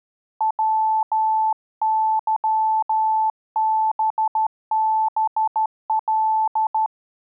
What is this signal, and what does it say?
Morse code, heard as a keyed tone, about 13 wpm, 880 Hz. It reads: WYBBL